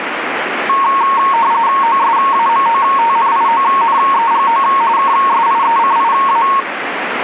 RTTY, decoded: OSAMOTNIONEGO KSIECIA

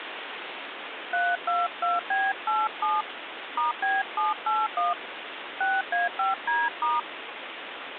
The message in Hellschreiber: none

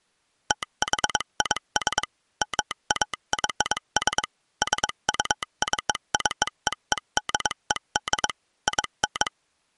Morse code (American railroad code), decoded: THIS MAYS SUCCEEDED IN

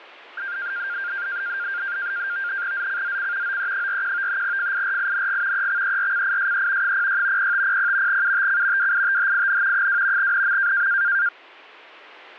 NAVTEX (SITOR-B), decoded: ZCZC OE41 FIRING EXERCISE 06 0500 UTC WITHIN 2 NM

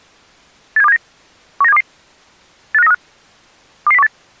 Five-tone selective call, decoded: 87279 19722 85935 22018

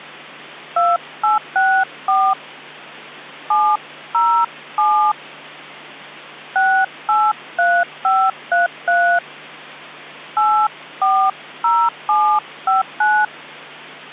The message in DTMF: 2864 707 683533 840759

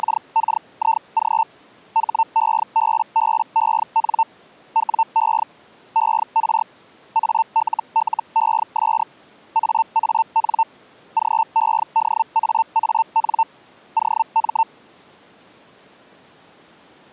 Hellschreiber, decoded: … HEBBEN WE ER ALLES AAN GEDAAN OM

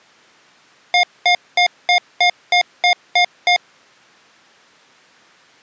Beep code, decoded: 9 short

